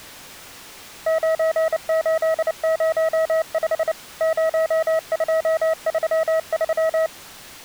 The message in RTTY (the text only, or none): none